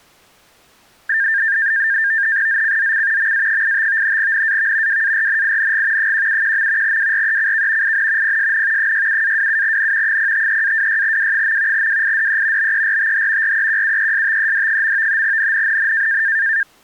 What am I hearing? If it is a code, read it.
NAVTEX (SITOR-B), 100 baud, 170 Hz shift, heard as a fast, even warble, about 1700 Hz centre. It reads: ZCZC MA85 NAV WARNING 171. WRECK IN PSN 67-27N 053-26W. WIDE BERTH REQUESTED. NNNN